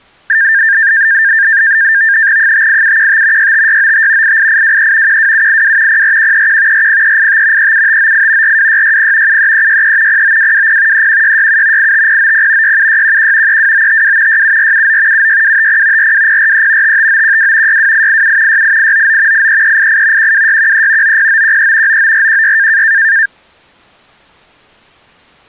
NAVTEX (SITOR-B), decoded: 58715 65695 88823 12782 04131 40385 37598 42660 73363 09220 31667 85090 67611 32952 67479 76250 42043 55912 62887 68899 83388 12613 90913 99416

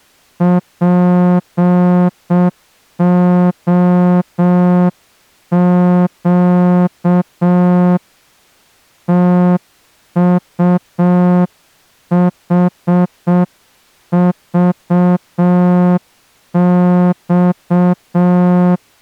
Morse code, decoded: POQ TUHVX

